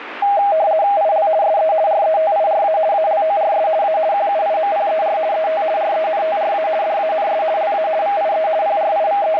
RTTY (50 baud, 170 Hz shift), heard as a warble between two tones, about 720 Hz centre, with radio static. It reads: IL SE RETIRA ALORS A QUIMPER ET RENTRA DANS LA VIE …